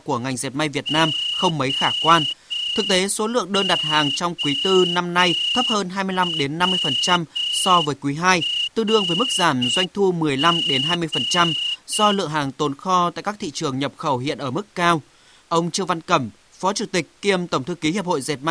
Morse code, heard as a whistle, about 6 wpm, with speech in Vietnamese. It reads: OOWRG